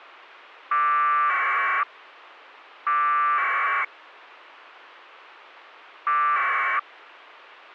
Packet radio (AX.25, as in APRS), 1200 baud, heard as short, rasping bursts.